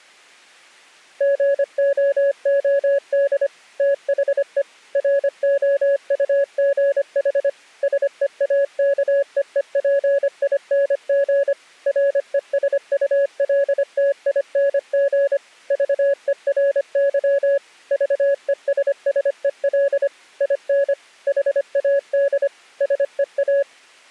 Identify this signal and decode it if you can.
Morse code, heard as a keyed tone, machine-sent, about 25 wpm, 560 Hz. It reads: GOOD THE ROUGH SEAKEEPING RESULTING VERY VESSEL IN HAD SEA